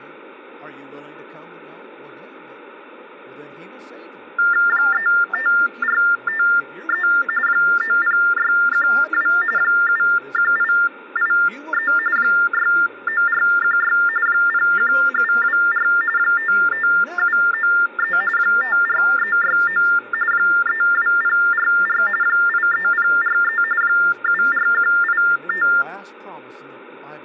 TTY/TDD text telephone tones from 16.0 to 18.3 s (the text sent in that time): 55793